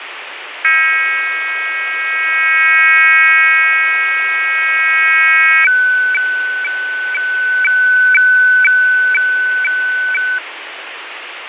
Weather fax (radiofax), 120 lines a minute, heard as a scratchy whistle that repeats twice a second, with radio static and fading.